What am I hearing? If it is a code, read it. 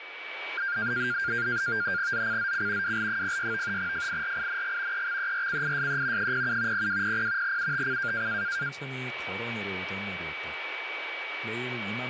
NAVTEX (SITOR-B), 100 baud, 170 Hz shift, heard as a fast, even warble, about 1500 Hz centre, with radio static, a steady whistle near 2280 Hz and speech in Korean. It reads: ZCZC WL06 FIRING EXERCISE 07 0200 UTC